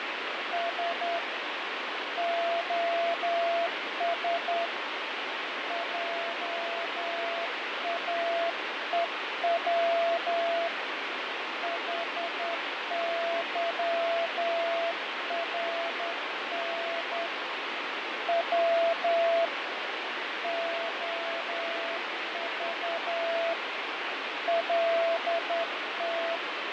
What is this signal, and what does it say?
Morse code, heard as a keyed tone, hand-sent with a straight key, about 10 wpm, 670 Hz, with heavy radio static and fading. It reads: S OS JAEW HYRN W OV LT